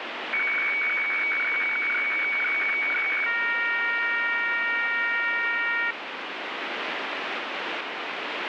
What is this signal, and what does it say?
Weather fax (radiofax), 120 lines a minute, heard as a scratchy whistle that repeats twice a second, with radio static.